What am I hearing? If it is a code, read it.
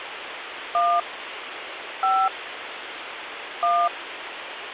DTMF, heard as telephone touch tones, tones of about 250 ms, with phone line noise. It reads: 1 5 1